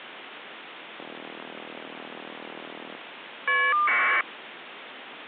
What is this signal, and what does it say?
Caller ID data burst, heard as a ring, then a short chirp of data, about 1200 baud, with phone line noise.